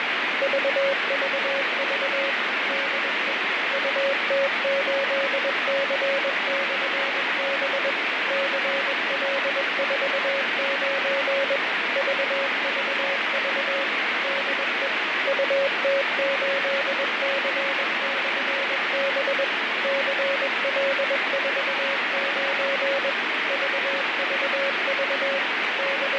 Morse code, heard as a keyed tone, machine-sent, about 21 wpm, 550 Hz, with heavy radio static and fading. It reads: VVV DE UT8C/B CL49 VVV DE UT8C/B CL49 VVV …